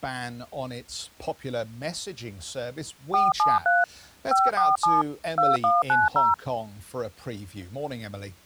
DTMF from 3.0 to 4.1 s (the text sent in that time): 473